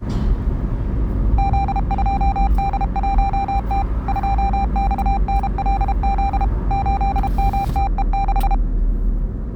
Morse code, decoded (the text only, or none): Z2D1T 2XNLZ 8MTE6